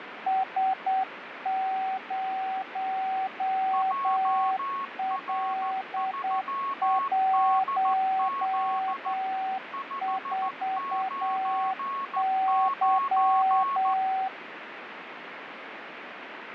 Morse code, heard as two keyed tones, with radio static. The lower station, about 8 wpm, 760 Hz: S0L14Y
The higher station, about 14 wpm, 1100 Hz: JR3DZ 599